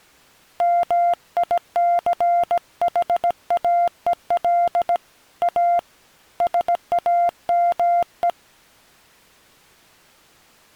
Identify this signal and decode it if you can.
Morse code, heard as a keyed tone, hand-sent with a paddle, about 17 wpm, 700 Hz. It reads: MICHAEL A SAME